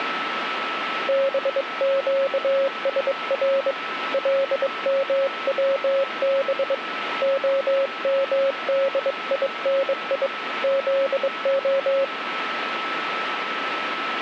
Morse code (Hebrew alphabet), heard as a keyed tone, hand-sent with a bug key, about 22 wpm, 540 Hz, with radio static and a steady whistle near 1310 Hz. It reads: בקשר למצב המדיני זה